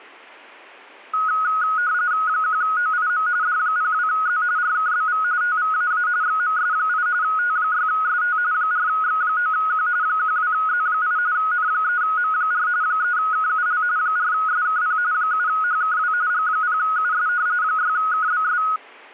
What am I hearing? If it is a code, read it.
RTTY (45.45 baud, 170 Hz shift), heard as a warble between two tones, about 1360 Hz centre. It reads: 1OIM D02Z RKBV TVAA XMS8 T6ST 4X9Q 12Z8 N3M4 3KUL 4SKP 7HKW G0US 6KBS